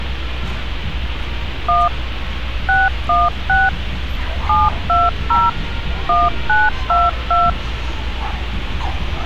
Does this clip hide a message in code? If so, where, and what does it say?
Yes: DTMF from 1.7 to 7.5 s, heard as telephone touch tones, dialled by machine, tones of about 200 ms, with radio hiss and street noise. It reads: 1 616 720 1922